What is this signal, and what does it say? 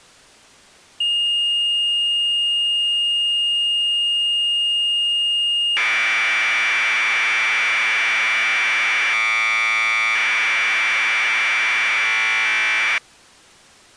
Commodore tape loading (standard loader), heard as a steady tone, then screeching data.